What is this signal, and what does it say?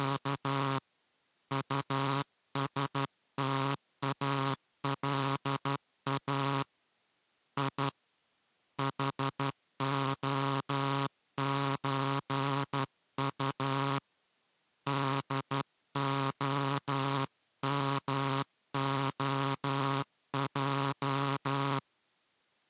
Morse code (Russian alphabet), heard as a buzzer, hand-sent with a straight key, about 12 wpm. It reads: … УСТАЛА И ХОЧУ ДОМОЙ